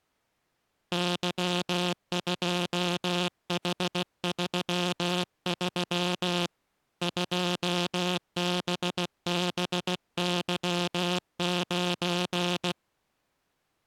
Morse code, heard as a buzzer, hand-sent with a paddle, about 16 wpm. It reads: Y2H33 2BBY9